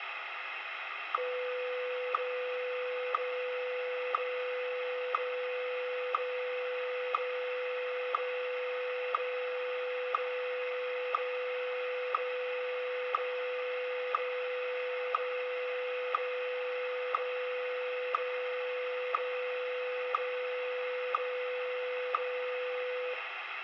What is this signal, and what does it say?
Radio time signal (WWVH, Hawaii), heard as ticks, one a second, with radio static and room echo.